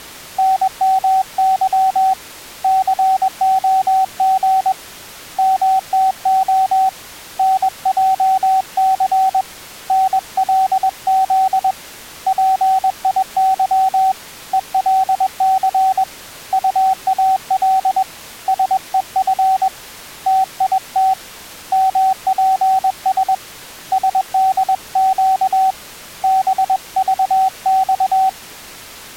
Morse code, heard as a keyed tone, hand-sent with a paddle, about 21 wpm, 760 Hz. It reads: NMY COG MTO NJC NLZ PIY ELC UAL SEF TIT MPS SDQ BVX